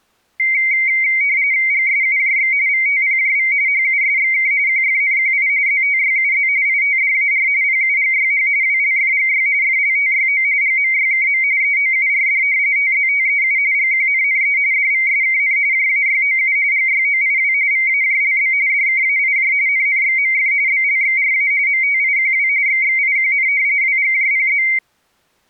RTTY (45.45 baud, 170 Hz shift), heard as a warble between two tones, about 2150 Hz centre. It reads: GSUJX VTPJV HUSXK QFNQI ZTYUZ ITDAR PUGYH WLFGY FLTYO GMYKM EOURD TZTEU GQNNE DVSKN JAYOU GYOIW VAJLB DKAIJ NNXMF BLXRA MTIQW XXIQN WGJPZ